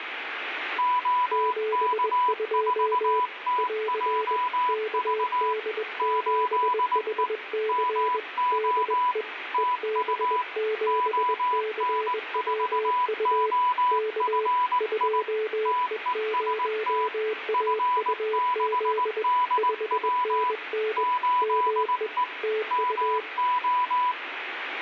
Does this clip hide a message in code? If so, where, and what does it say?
Yes: Morse code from 0.7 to 24.2 s, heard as two keyed tones, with radio static and room echo. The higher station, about 19 wpm, 990 Hz: OK4TJV 8E MO TU ON4OFI TEST F6DW 8E MO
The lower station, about 21 wpm, 430 Hz: 72 <AR> KD7HC DE EB7CWU K 2E0AUZ 5NN ME TU